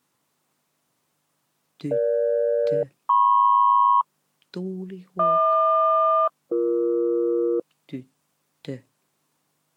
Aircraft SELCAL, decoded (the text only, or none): EG-MP HQ-BE